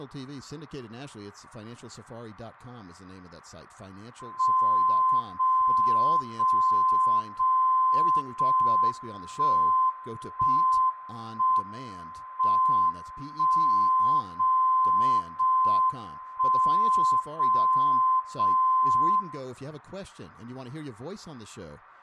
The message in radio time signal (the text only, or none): 0 0 0 0 1 1 1 M 1 0 0 1 0 0 0